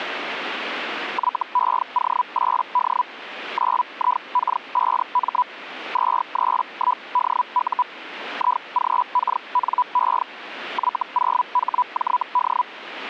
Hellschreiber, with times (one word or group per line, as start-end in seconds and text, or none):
1.1-3.0 YEO8D
3.5-5.4 9IK5M
5.9-7.8 231DU
8.3-10.2 IGKNE
10.7-12.6 Y0HJD